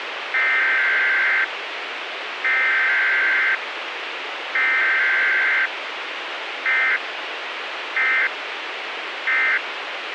Emergency Alert System (SAME) tones (header bursts, then end-of-message bursts), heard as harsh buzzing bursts, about 520.83 baud, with radio hiss.